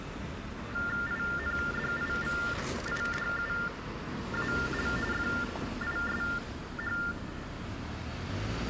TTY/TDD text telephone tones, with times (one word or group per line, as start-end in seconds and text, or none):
1.1-4.9 INDIVIDUAL
5.1-7.0 FISH